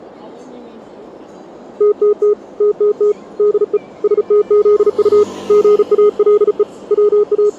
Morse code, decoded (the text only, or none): TTT TTT DE STZU GALE …